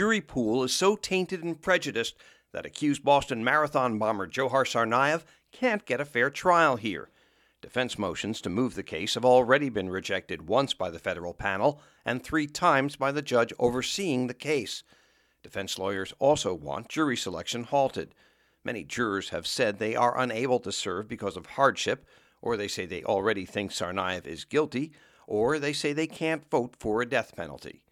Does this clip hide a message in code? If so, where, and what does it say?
No.